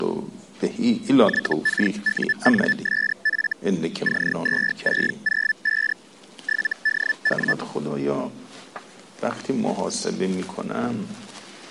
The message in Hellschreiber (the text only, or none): YKUNSF C2605 7DW